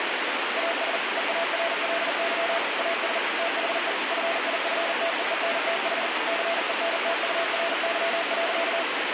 Morse code, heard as a keyed tone, machine-sent, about 40 wpm, 670 Hz, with heavy radio static. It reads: AS EARLY AS THE FIFTEENTH CENTURY.